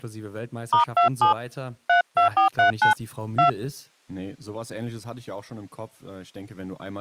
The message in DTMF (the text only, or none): *27 32439 2